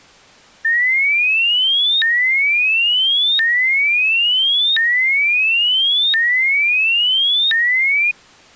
A tone that sweeps in pitch again and again. There is no code.